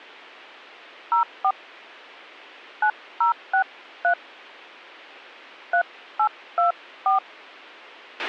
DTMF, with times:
1.1-1.5 04
2.8-4.1 9063
5.7-7.2 3824

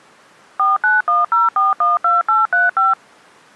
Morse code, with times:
none

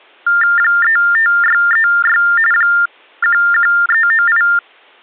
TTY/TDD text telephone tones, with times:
0.6-2.2 35636
2.5-4.4 11398

